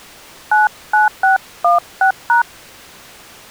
DTMF, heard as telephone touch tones, dialled by hand, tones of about 120 ms. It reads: 99616#